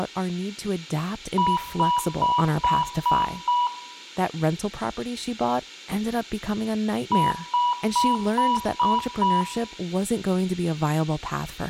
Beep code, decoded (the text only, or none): 6 short